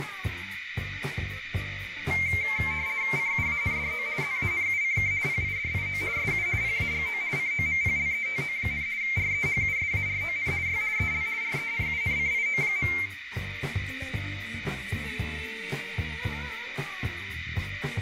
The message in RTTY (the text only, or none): CUANDO ZANUCK PIDIO SU PAGO COMPLETO, REHUSARON Y EL RENUNCIO.